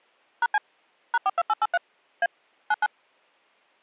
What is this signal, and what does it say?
DTMF, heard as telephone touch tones, dialled by machine, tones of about 40 ms. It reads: #C #42883 A 99